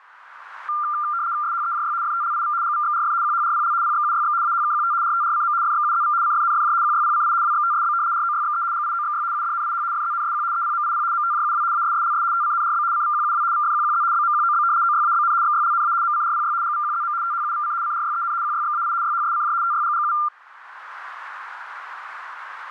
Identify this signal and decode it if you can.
RTTY (75 baud, 170 Hz shift), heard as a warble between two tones, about 1290 Hz centre. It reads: SHEJY FTLIV GVXRF QHRPL PXUYX AHKQT RTRCM FXUZV CFNFJ QYPCI WXTSB ROYXE GIOXY UDNIH FZNSQ EPMIP MTJUW ASSLS TCNRB CVQUW VFQQZ BMQOB OYABN XYLNA MCRPY GVQZM THUVC CRYEN QYXAI YHSCJ TYGGU